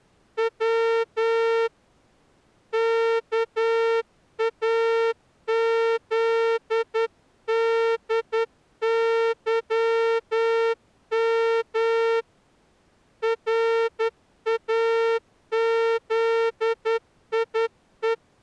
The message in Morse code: W KAZDYM RAZIE

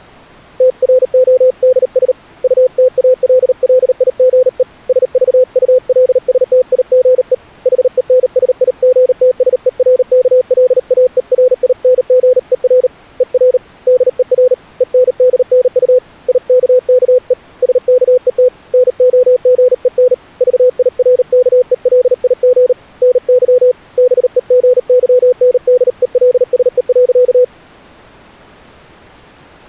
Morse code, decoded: TRODS UTALLIGE SVULSTIGE HENSIGTSERKLAERINGER ER DER ENDNU IKKE SKET NOGEN VIRKELIG NY BEGYNDELSE.

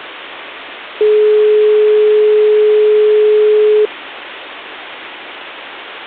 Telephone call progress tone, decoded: dial tone

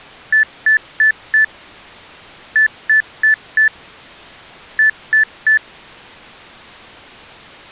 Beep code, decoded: 4-4-3

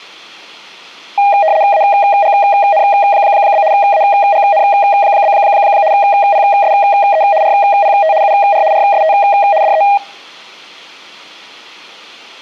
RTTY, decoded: AGN? AGN? PSE RPT UR RST DE

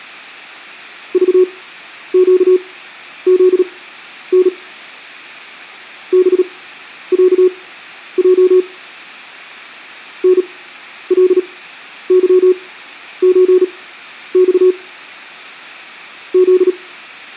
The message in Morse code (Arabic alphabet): ضقذن بعج نلظزص ذ

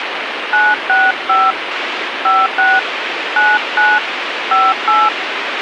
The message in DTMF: 965 56 99 58

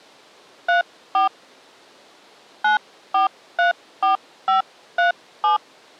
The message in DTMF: 34 9434537

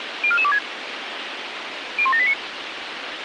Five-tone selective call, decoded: 04426 01789

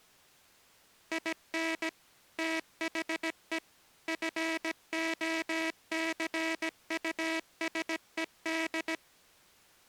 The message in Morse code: IN THE FOCUSED

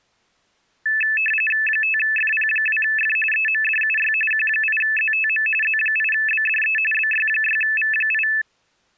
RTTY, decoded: 5FP2F EMDUY Q8ZTM Z8BDE BY6V8

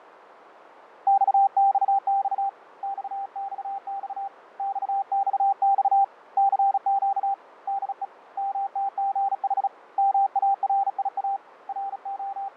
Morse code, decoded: XXX XXX XXX CQ DE MTGH MARIA …

